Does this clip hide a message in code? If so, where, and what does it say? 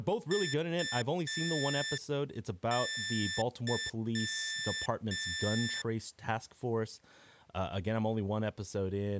Yes: Morse code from 0.3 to 5.9 s, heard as electronic beeps, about 5 wpm, 1750 Hz, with speech in English. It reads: UY